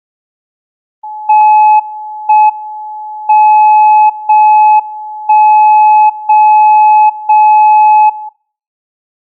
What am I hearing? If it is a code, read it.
Radio time signal (JJY), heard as a tone whose level steps once a second, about 850 Hz. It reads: 1 M 0 1 0 0 0